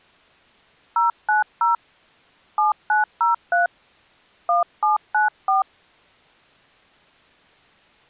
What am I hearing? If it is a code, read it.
DTMF, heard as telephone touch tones, dialled by hand, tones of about 140 ms. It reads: 090 7903 1794